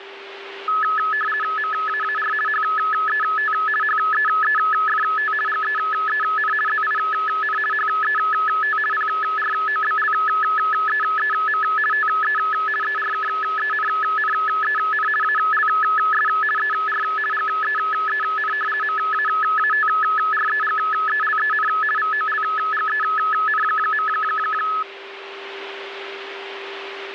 RTTY (50 baud, 450 Hz shift), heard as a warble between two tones, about 1500 Hz centre, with radio static and a steady whistle near 390 Hz. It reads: MAAR HET HEEFT GEEN ZIN HET PROBLEEM TE ERKENNEN ALS ER GEEN MAATREGELEN VOLGEN.